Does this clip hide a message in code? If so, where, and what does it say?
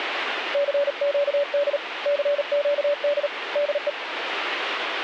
Yes: Morse code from 0.5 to 4.0 s, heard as a keyed tone, hand-sent with a paddle, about 38 wpm, 580 Hz, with radio static. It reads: CQD CQD DE